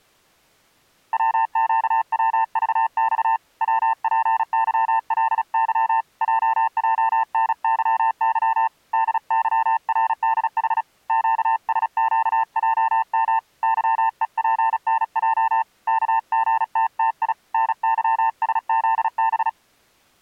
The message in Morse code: WQWVX WPYLY JJNYY DYRDH QSQJM YEPNJ KGTTI NYSZB

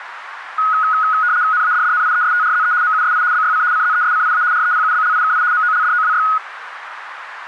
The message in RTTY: NADDNIESTRZE MUSI BYC CZESCIA REPUBLIKI MOLDOWY

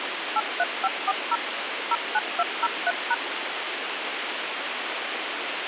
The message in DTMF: 83540 09203#

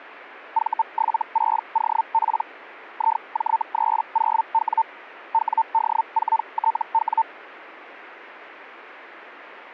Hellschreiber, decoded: V76OP IJ30W WD4TW

